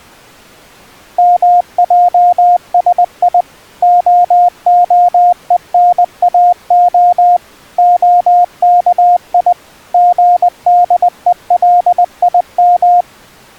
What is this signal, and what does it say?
Morse code (Hebrew alphabet), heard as a keyed tone, machine-sent, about 20 wpm, 710 Hz. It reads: מעשי ההונאה הכי גדולים